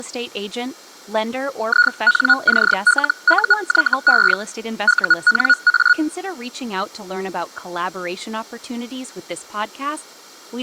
Hellschreiber (Feld-Hell, 122.5 baud), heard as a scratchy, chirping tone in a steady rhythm, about 1450 Hz, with speech in English. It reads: INCLUYE UNA